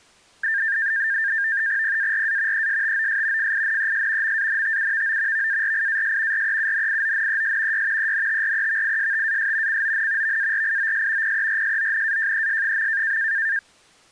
NAVTEX (SITOR-B), 100 baud, 170 Hz shift, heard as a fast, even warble, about 1700 Hz centre. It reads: PARA ESTOS FINES MANTUVO VARIAS REUNIONES Y ENTREVISTAS CON VARIOS PERSONAJES.